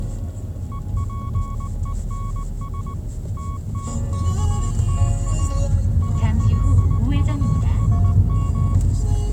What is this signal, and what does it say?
Morse code, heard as a keyed tone, machine-sent, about 19 wpm, 1110 Hz, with the noise inside a car. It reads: EPENS TTKTA ILUSM